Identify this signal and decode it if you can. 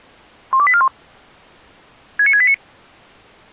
Five-tone selective call (ZVEI), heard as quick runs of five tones, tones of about 70 ms. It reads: 12841 69689